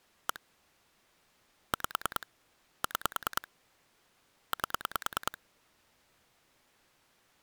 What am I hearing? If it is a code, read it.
Pulse dialling, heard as clicks on a phone line, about 9 pulses a second. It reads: 1 5 6 8